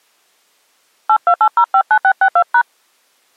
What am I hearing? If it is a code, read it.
DTMF, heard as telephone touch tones, dialled by hand, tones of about 70 ms. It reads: 828059662#